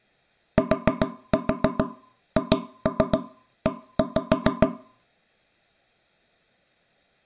Tap code, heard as knocks on wood, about 7 knocks a second, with room echo. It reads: THE